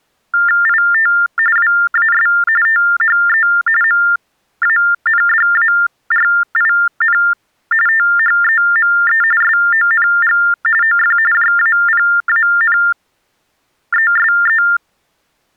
TTY/TDD text telephone tones (45.45 baud Baudot), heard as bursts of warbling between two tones, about 400 Hz shift, 1600 Hz centre. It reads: IT WAS THE MANDARIN THEME SONG OF JAPANESE